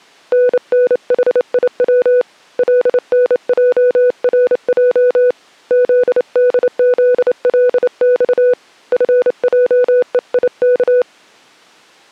Morse code, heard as a keyed tone, hand-sent with a straight key, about 28 wpm, 500 Hz. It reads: NNHIW LNJRJ ZDZLX FJEIK